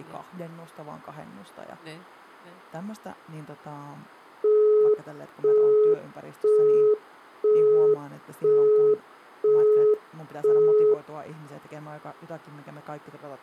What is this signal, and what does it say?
Telephone call progress tone (single-tone plan, as in Europe, Japan and elsewhere), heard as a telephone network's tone, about 420 Hz, 0.5 s on and 0.5 s off, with room echo and speech in Finnish. Busy tone.